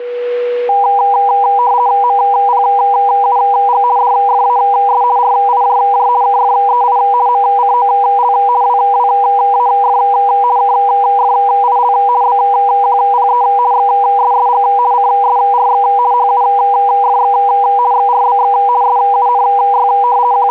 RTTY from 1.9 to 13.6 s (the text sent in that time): MPUG DFAS RIJJ KFEI MCOL WWAF KFIL BQPE